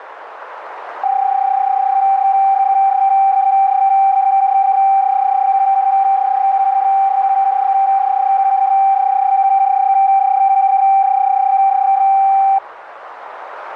PSK31 (31.25 baud), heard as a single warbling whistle, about 780 Hz, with radio static.